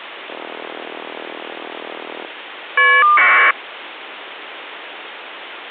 Caller ID data burst, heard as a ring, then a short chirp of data, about 1200 baud, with phone line noise.